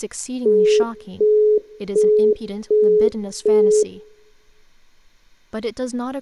Telephone call progress tone (as in the UK, Australia and similar networks), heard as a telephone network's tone, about 420 Hz, 0.375 s on and 0.375 s off, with room echo and speech in English. Busy tone.